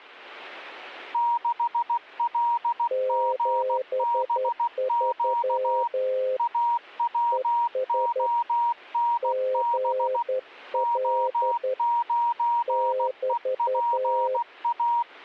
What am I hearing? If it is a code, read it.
Morse code, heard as two keyed tones. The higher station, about 16 wpm, 950 Hz: 6LGBQ AWONB O9EPA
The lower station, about 11 wpm, 520 Hz: 73 ES GL <BT>